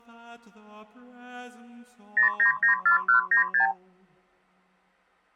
Multi-frequency trunk signalling (R2, with the far end's replies), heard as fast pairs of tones, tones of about 110 ms. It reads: 0994196